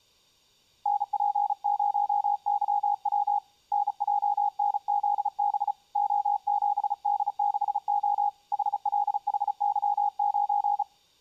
Morse code, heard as a keyed tone, hand-sent with a paddle, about 35 wpm, 820 Hz. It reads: NP0YW NJNZB O7D6O HLHY9